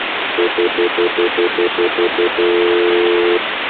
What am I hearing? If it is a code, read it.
Telephone call progress tone (North American plan), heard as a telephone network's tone, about 350, 440 Hz, 0.1 s on and 0.1 s off, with phone line noise. Stutter dial tone.